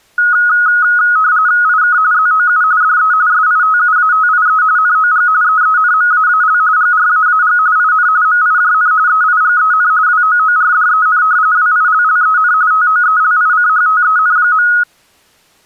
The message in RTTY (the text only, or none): IK ZOU DE SITUATIE NOG EENMAAL GRAAG IN MIJN EIGEN WOORDEN WILLEN TOELICHTEN.